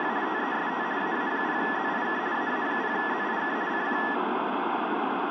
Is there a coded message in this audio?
Yes: RTTY (50 baud, 170 Hz shift) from 0.0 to 4.1 s, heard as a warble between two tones, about 1800 Hz centre, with radio static and room echo. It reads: … TEST AA0ZIK AA0ZIK CQ